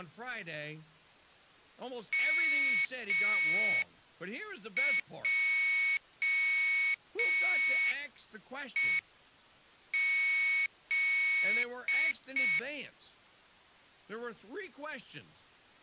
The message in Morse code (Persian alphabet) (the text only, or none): مجهز